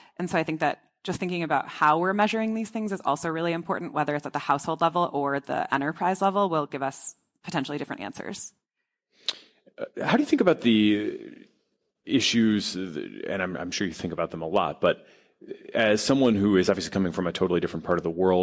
Speech in English. There is no code.